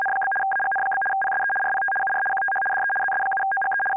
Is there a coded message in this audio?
Yes: RTTY (75 baud, 850 Hz shift) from 0.0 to 4.0 s, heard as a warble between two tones, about 1200 Hz centre. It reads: … AGN? PSE RPT UR QTH DE ZS7OGE …